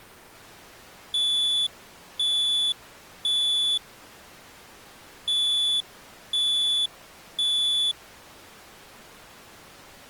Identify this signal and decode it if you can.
Alarm pattern, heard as an alarm's beeps, played twice, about 3450 Hz. Temporal three. Smoke or fire, evacuate.